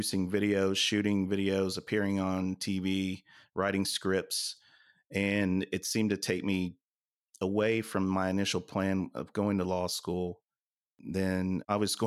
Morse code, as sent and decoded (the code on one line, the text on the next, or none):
none